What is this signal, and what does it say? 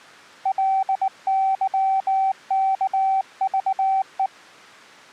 Morse code, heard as a keyed tone, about 19 wpm, 770 Hz. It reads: LYKVE